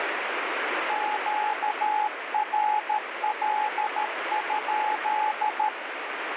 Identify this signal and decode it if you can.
Morse code, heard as a keyed tone, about 13 wpm, 850 Hz, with heavy radio static. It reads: QRL?